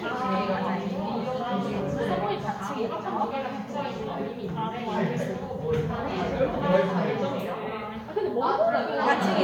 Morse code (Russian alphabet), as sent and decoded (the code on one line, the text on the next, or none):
none